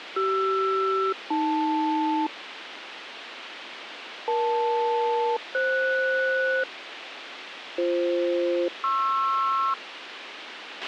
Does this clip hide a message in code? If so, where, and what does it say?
Yes: aircraft SELCAL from 0.2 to 9.7 s, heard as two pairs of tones, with radio hiss and a squelch burst at the end. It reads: CR-AL EL-FS BF-PR